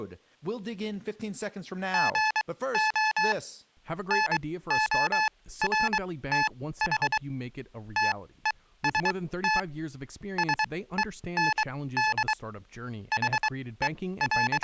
Morse code, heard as electronic beeps, machine-sent, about 23 wpm, spaced as for 16 wpm, 860 Hz, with speech in English. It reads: GO NORTH TEST SEND …